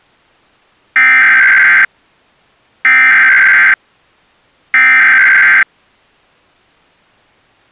Emergency Alert System (SAME) tones (header bursts), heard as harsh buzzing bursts, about 520.83 baud.